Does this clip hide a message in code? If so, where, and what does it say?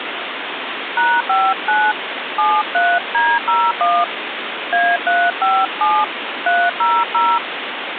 Yes: DTMF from 1.0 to 7.4 s, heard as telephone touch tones, dialled by hand, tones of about 240 ms, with phone line noise. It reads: #59 73D01 A357 300